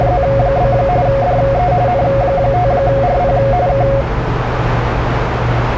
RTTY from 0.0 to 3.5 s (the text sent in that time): … DE N5RP